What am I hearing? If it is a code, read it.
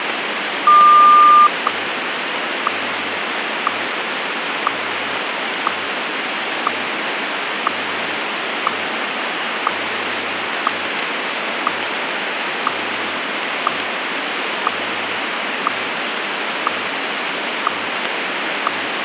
Radio time signal (WWVH, Hawaii), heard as ticks, one a second, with radio static.